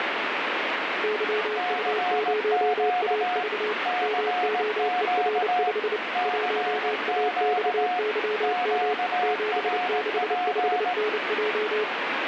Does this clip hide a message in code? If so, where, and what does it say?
Yes: Morse code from 1.0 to 11.9 s, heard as two keyed tones, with heavy radio static. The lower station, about 29 wpm, 430 Hz: YU0AV MOER5 1AXYM 765NJ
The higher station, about 18 wpm, 720 Hz: CQ CQ CQ QRP